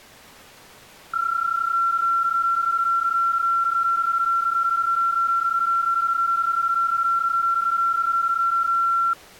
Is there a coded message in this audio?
Yes: PSK31 (31.25 baud) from 1.1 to 9.1 s, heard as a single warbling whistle, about 1360 Hz.